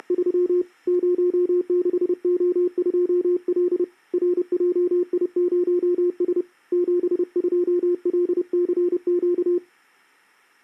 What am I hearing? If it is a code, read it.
Morse code, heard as a keyed tone, hand-sent with a paddle, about 30 wpm, 360 Hz. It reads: … 06O2L RJI0S 72LCQ